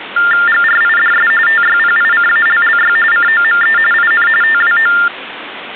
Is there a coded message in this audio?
Yes: TTY/TDD text telephone tones (45.45 baud Baudot) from 0.2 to 5.1 s, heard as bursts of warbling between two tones, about 400 Hz shift, 1600 Hz centre, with phone line noise. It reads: GRIDS TYPICALLY COME IN TWO